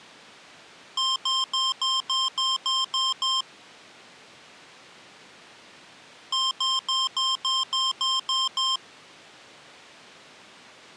Beep code, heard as beeps from a small speaker, played twice, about 1060 Hz. 9 short. In AMI BIOS tables: ROM checksum failure.